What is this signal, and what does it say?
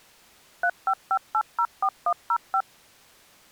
DTMF, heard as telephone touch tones, dialled by machine, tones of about 70 ms. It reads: 355804105